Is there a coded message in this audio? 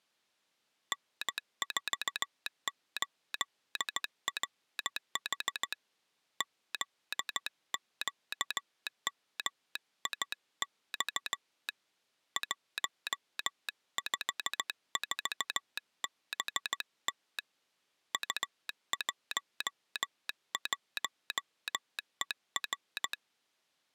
Yes: Morse code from 0.9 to 23.2 s, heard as a telegraph sounder, hand-sent with a straight key, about 15 wpm. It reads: N48RH ZQMIX 154BT U11ER